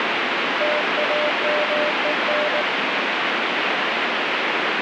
Morse code, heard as a keyed tone, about 19 wpm, 600 Hz, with heavy radio static. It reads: TAMEN